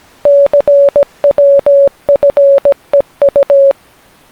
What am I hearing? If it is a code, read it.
Morse code, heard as a keyed tone, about 17 wpm, 560 Hz. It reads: CWFEU